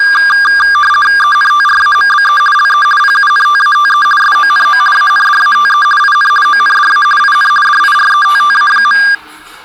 RTTY (50 baud, 450 Hz shift), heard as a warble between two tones, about 1400 Hz centre, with the noise of a crowd indoors. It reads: ENTRAMBE LE PUNTATE SONO ANDATE IN ONDA IN DIRETTA.